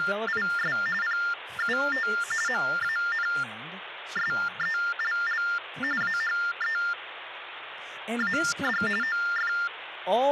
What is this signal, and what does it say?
TTY/TDD text telephone tones (45.45 baud Baudot), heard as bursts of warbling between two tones, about 400 Hz shift, 1600 Hz centre, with phone line noise and speech in English. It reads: … PUT MANSELL AHEAD OF